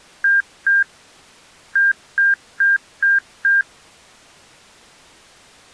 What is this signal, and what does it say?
Beep code, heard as beeps, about 1600 Hz. 2-5.